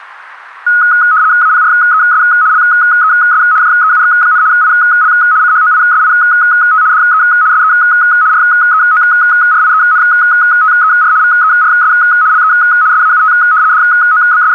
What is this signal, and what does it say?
RTTY (75 baud, 170 Hz shift), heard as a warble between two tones, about 1360 Hz centre, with static crashes. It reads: APRES LES JEUX, IL CHOISIT DE SE REORIENTER VERS LE SAUT …